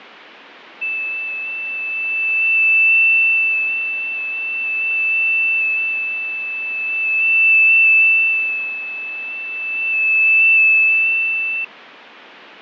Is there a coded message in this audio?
Yes: FT8 (one signal) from 0.8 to 11.6 s, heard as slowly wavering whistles, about 6.25 baud, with radio static and fading.